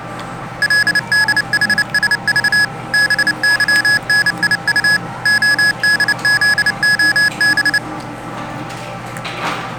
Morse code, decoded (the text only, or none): LDHSV BYNIU ODZOB